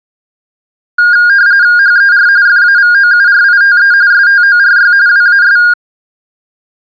RTTY (45.45 baud, 170 Hz shift), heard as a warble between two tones, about 1500 Hz centre. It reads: HER FAVOURITE STORY WAS